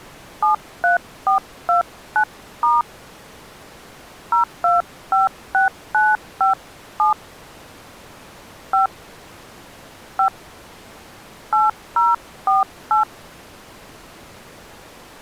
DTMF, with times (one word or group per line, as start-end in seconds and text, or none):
0.4-2.8 73429*
4.3-7.1 0256957
8.7-8.9 5
10.2-10.3 5
11.5-13.0 8048